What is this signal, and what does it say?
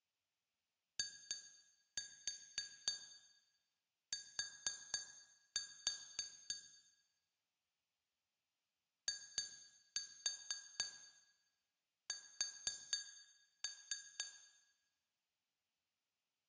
Tap code, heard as taps on glass, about 3 knocks a second, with room echo. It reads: IT IS